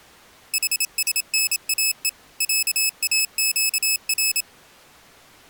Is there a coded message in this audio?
Yes: Morse code (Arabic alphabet) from 0.5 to 4.5 s, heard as a high beeper, machine-sent, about 27 wpm, 2600 Hz. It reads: حسناء عاقر